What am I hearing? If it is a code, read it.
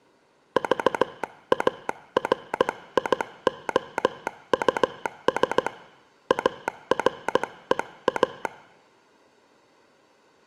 Morse code, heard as a telegraph sounder, hand-sent with a paddle, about 16 wpm, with room echo. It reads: VARIOUS AREA